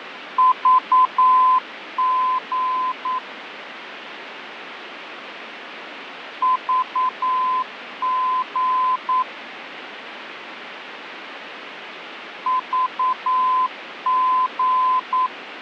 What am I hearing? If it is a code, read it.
Morse code, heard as a keyed tone, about 9 wpm, 1020 Hz, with radio static and fading. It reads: VG VG VG